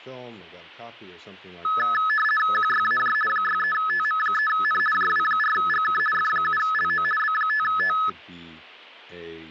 RTTY (50 baud, 450 Hz shift), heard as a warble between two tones, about 1500 Hz centre, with speech in English. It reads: QYAJ 63TM3N JW4GK F7LO B5T